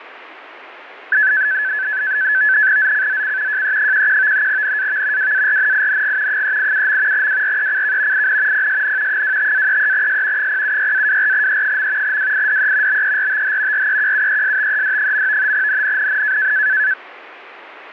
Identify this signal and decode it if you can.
NAVTEX (SITOR-B), 100 baud, 170 Hz shift, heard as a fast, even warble, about 1600 Hz centre, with radio static. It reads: ZCZC JE11 NAV WARNING 387. WRECK IN PSN 25-33S 076-24E. WIDE BERTH REQUESTED. NNNN